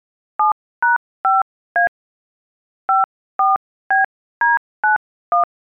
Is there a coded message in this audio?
Yes: DTMF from 0.4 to 5.4 s, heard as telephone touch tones, dialled by hand, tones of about 140 ms. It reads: 7#5A 54BD91